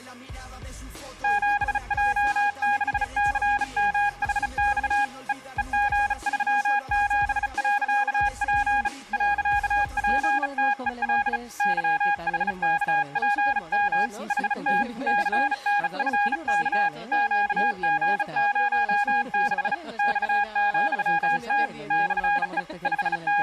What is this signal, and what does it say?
Morse code, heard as a keyed tone, hand-sent with a bug key, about 35 wpm, 820 Hz, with room echo. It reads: 7J6CMHX E EG37.P .PTEL YHKPM HT CNFK QG06 X,T /E …